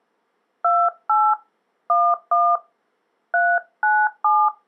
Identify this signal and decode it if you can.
DTMF, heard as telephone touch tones, dialled by hand, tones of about 240 ms. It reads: 28 11 397